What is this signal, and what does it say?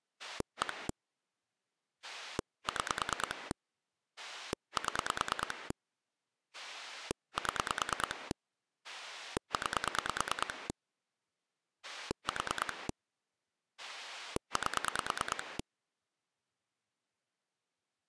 Pulse dialling, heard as a rotary dial, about 9 pulses a second. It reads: 1 6 7 7 9 4 8